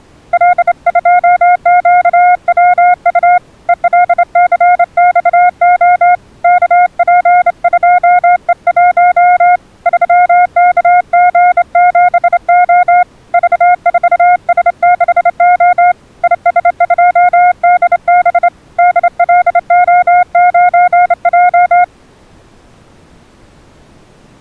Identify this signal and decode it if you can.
Morse code, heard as a keyed tone, hand-sent with a straight key, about 28 wpm, 720 Hz. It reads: L2QWU ELCXO KP2E1 3KG7O V4S6O IS2DB DLO9J